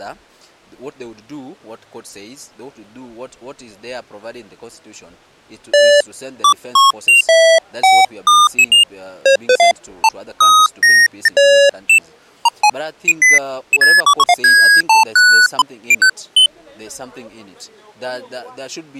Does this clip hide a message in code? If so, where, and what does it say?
No, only electronic bleeps of random pitch and length.